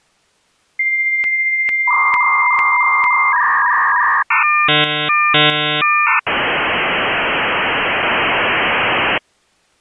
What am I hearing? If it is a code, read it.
Dial-up modem handshake (V.34 or later), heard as a whistle, warbles, then hiss.